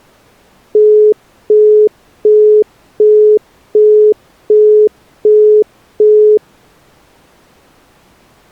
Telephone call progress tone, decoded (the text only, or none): busy tone